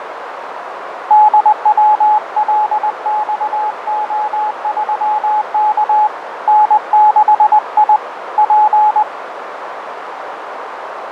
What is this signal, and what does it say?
Morse code, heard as a keyed tone, hand-sent with a paddle, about 20 wpm, 850 Hz, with radio static, fading and a narrow filter. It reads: DWLXO3K N6I P